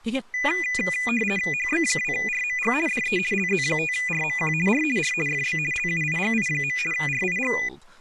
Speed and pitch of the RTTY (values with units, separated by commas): 50 baud, 450 Hz shift, 2200 Hz centre